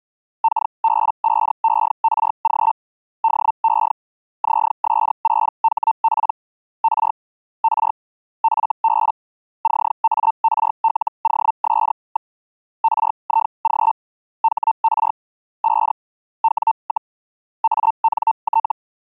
Hellschreiber (Feld-Hell, 122.5 baud), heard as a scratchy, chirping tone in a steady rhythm, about 900 Hz. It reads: KB5ERG DE ZS6HP R R FB CARLOS. RIG HR 5 W, ANT